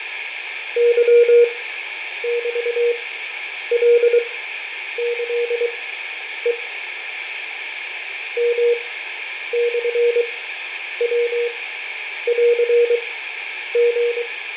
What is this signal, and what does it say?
Morse code (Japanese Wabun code), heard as a keyed tone, machine-sent, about 23 wpm, spaced as for 9 wpm, 480 Hz, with radio static, fading and room echo. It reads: ケメカキヘ ヨモヤンリ